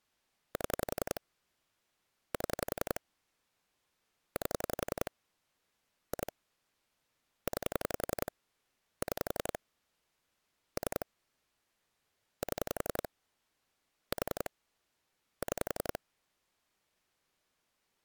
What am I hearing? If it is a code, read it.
Pulse dialling, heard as clicks on a phone line, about 11 pulses a second. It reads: 7 7 8 2 9 6 3 7 4 6